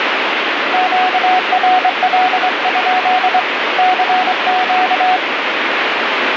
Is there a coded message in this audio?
Yes: Morse code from 0.7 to 5.2 s, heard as a keyed tone, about 24 wpm, 740 Hz, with radio static. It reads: QRL? CQ